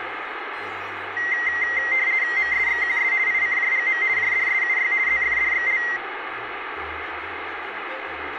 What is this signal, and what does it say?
RTTY (50 baud, 170 Hz shift), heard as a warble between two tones, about 2000 Hz centre, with radio static. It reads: MSXQS ICJGM JDSUY ZFDXL